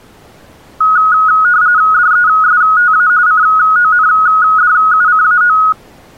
RTTY (45.45 baud, 170 Hz shift), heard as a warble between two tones, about 1360 Hz centre. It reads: DESTA CONDUCAO